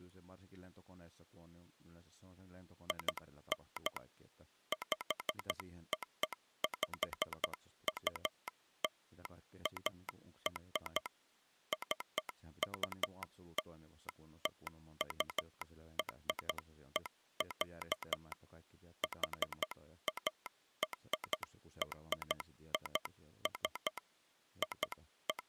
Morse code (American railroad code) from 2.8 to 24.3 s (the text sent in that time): IN POPULAR CULTURE, HARRIS